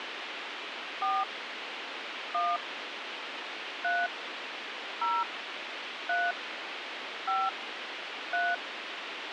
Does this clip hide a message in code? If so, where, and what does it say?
Yes: DTMF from 1.0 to 8.5 s, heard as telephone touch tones, dialled by hand, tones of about 220 ms, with radio hiss and a squelch burst at the end. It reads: 4 1 3 0 3 5 3